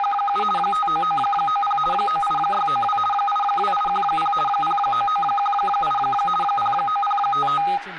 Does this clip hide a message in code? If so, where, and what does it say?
Yes: RTTY (50 baud, 450 Hz shift) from 0.0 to 7.8 s, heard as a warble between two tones, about 1030 Hz centre, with static crashes and speech in Dogri. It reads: … 59990 98692 82810 09918 09055